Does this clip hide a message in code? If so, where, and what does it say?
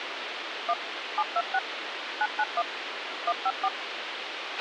Yes: DTMF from 0.7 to 3.7 s, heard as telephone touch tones, dialled by machine, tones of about 50 ms, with radio hiss and a squelch burst at the end. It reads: 1 726 991 154